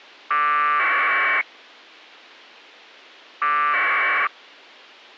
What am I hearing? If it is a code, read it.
Packet radio (AX.25, as in APRS), 1200 baud, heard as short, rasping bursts.